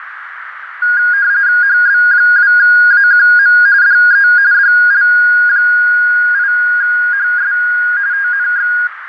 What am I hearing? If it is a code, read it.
RTTY (45.45 baud, 170 Hz shift), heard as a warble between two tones, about 1550 Hz centre, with radio static and a narrow filter. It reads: HB2AQM DE DL8HS TNX